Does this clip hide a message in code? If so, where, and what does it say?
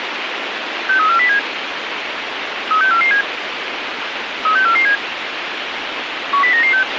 Yes: five-tone selective call (CCIR) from 0.9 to 6.8 s, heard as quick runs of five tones, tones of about 100 ms, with radio hiss and a squelch burst at the end. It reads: 63407 36447 36447 10996